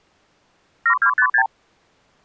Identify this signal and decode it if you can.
Multi-frequency trunk signalling (R2, with the far end's replies), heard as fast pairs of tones, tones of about 80 ms. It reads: 7256